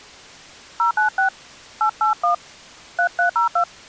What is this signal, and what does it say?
DTMF, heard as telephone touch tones, dialled by hand, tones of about 110 ms. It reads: 096 881 3302